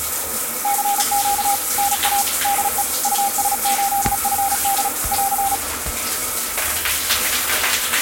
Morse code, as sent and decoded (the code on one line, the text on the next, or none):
-.-. --.- / -. .- / -.. . / ..- ... ---.. ..-. -.. / .-.-.
CQ NA DE US8FD <AR>